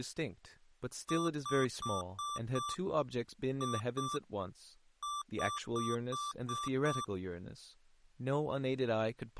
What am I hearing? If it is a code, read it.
Beep code, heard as beeps from a small speaker, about 1170 Hz, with speech in English. 5-2-6.